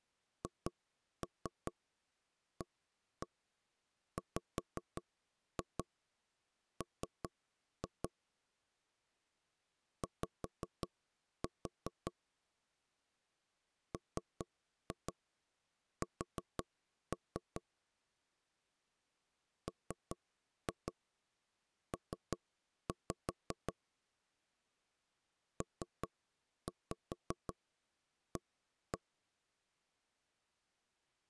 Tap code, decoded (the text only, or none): HAWM Y MS MP PA